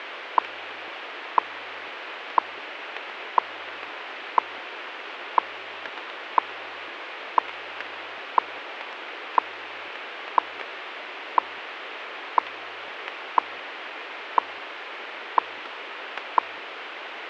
Radio time signal (WWV, Colorado), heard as ticks, one a second, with radio static.